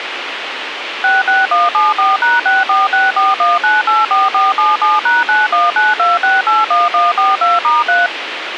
DTMF, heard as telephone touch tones, dialled by machine, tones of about 180 ms, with radio hiss. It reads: 66174#64641984477#9192681142*3